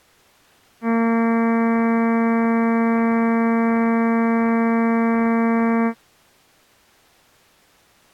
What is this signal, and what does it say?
Ship horn signal, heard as a ship's horn, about 230 Hz. 1 long. At sea: a vessel nearing a blind bend, or under power and making way in fog.